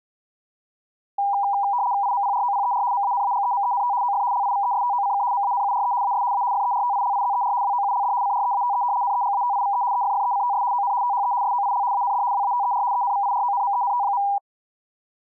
RTTY (75 baud, 170 Hz shift), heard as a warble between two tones, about 890 Hz centre. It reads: IMPROPER MANAGEMENT OF LIVESTOCK MANURE AS A FERTILIZER WOULD CREATE NEGATIVE EFFECTS ON THE SOIL AND WATER ENVIRONMENT.